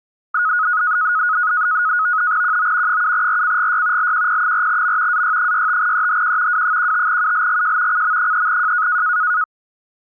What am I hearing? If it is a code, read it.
NAVTEX (SITOR-B), 100 baud, 170 Hz shift, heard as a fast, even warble, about 1360 Hz centre. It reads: QO 7RCGY LQP4M AY65EHQ W15ULGJ CM3J